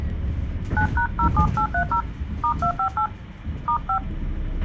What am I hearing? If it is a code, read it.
DTMF, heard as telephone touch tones, dialled by hand, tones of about 90 ms, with a squelch burst at the end and the noise inside a bus. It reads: 9#07830 *258 *5